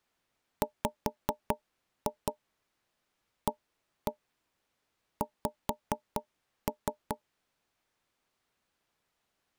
Tap code, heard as knocks on wood, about 4 knocks a second. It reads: WAX